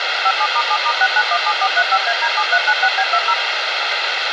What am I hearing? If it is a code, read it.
DTMF, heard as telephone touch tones, dialled by machine, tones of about 60 ms, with radio hiss and a squelch burst at the end. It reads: 57*7*6917435AD7396B20